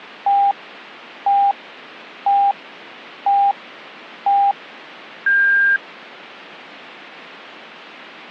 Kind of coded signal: radio time signal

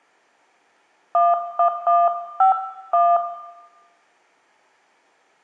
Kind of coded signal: DTMF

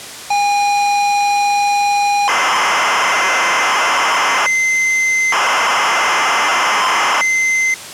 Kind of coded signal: ZX Spectrum tape loading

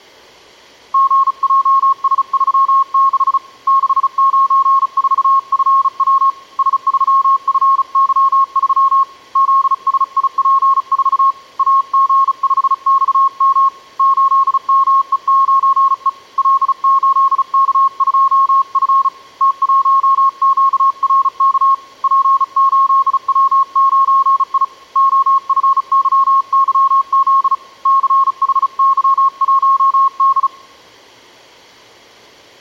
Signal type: Morse code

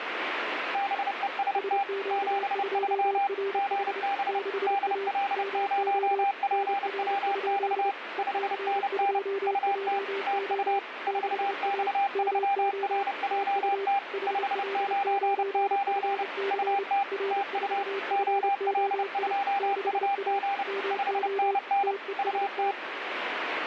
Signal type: Morse code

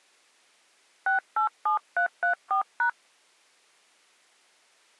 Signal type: DTMF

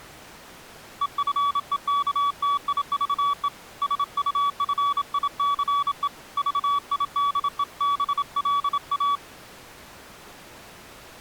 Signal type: Morse code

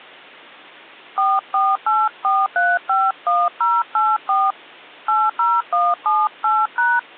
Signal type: DTMF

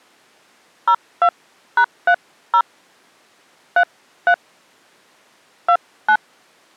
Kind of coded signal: DTMF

